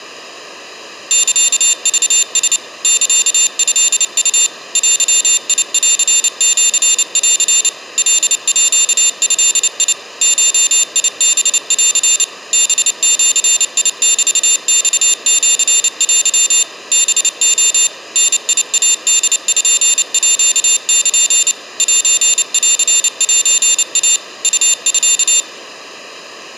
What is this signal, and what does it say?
Morse code (Japanese Wabun code), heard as a high beeper, machine-sent, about 29 wpm, 3600 Hz, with room echo. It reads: サクラ サトウ デンシン カード ゴハン ハジメマシテ ハレ ダイポール センセイ ウミ